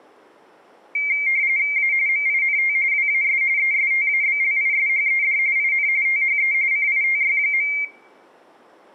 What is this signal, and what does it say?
RTTY (45.45 baud, 170 Hz shift), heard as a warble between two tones, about 2200 Hz centre. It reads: A MINT WAS ESTABLISHED IN THE CITY.